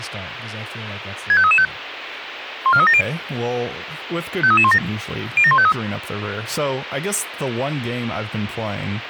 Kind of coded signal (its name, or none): five-tone selective call